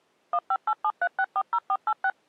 DTMF, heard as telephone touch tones, dialled by machine, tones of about 60 ms. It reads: 15873640486